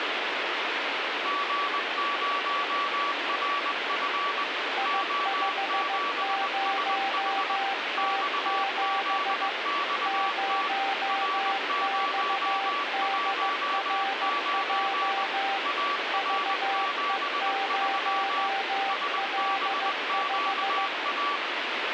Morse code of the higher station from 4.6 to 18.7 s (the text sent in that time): O7SH XZXT R019 AR73